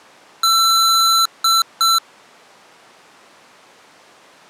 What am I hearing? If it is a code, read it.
Beep code, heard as beeps from a small speaker, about 1340 Hz. 1 long, 2 short. In Award, IBM and AMI BIOS tables: video adapter failure.